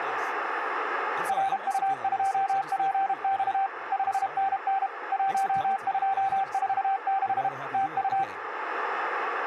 Morse code, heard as a keyed tone, machine-sent, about 32 wpm, 780 Hz, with radio static, a narrow filter and speech in English. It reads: RU2PX 5NN 1246 TU